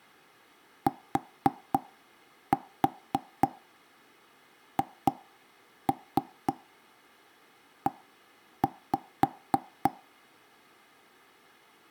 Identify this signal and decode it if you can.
Tap code, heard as knocks on wood, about 3 knocks a second. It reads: THE